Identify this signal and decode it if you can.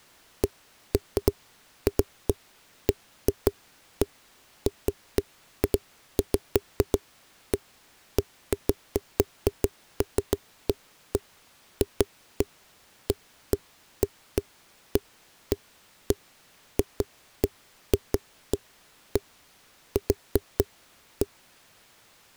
Irregular knocks on a wall. There is no code.